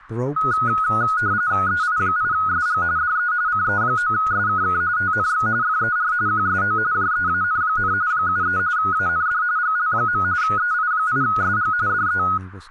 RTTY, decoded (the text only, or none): EI8SG DE CE9SKK TNX FER QSO JEAN, 73 AND GL. EI8SG DE